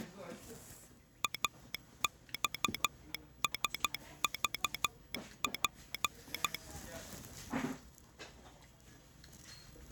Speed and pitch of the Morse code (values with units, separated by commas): 12 wpm